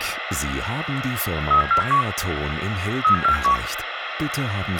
Five-tone selective call (CCIR), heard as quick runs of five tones, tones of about 100 ms, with radio hiss and a squelch burst at the end. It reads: 37471 37471